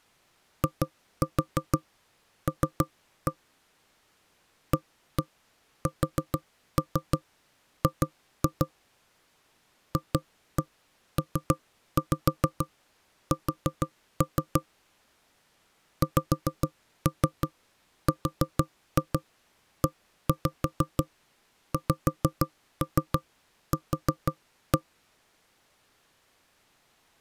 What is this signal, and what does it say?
Tap code, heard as knocks on wood, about 6 knocks a second. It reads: IL ASG FPS XREXQ